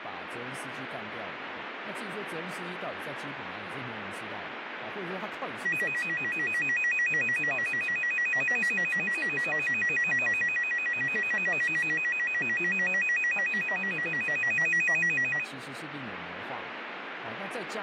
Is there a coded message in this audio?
No, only a tone that alternates evenly between two pitches, with radio static and speech in Chinese.